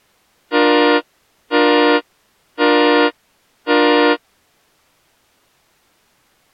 Train horn signal, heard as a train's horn. 4 short. On North American railways: a request for a signal to be given or repeated.